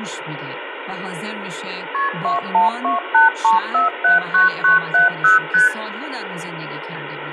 Multi-frequency trunk signalling (R1, as on North American trunks), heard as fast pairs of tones, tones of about 140 ms, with phone line noise and speech in Persian. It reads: KP 21283479970 ST